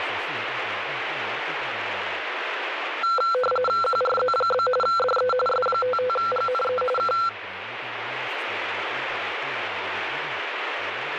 RTTY (45.45 baud, 850 Hz shift), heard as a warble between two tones, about 930 Hz centre, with radio static. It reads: QRZ? DE S55GNE K